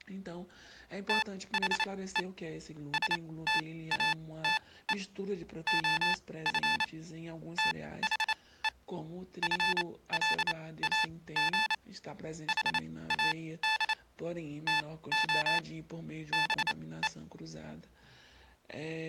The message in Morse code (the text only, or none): THE STATE OF THE FLAG HAD TO BE